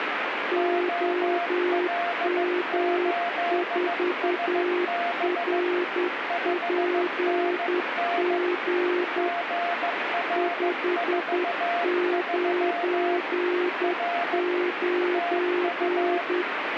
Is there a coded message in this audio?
Yes: Morse code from 0.5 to 16.5 s, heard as two keyed tones, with radio static. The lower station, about 10 wpm, 360 Hz: OM4RPG 599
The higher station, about 15 wpm, 690 Hz: OL8SB 5NN GR43 R TU